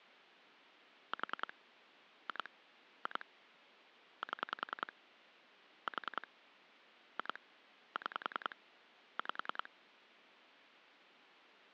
Pulse dialling, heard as clicks on a phone line, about 10 pulses a second. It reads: 4 2 2 7 4 2 6 5